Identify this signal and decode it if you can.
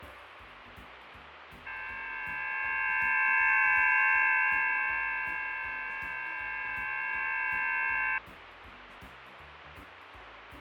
FT8 (several signals at once), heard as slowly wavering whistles, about 6.25 baud, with radio static and fading.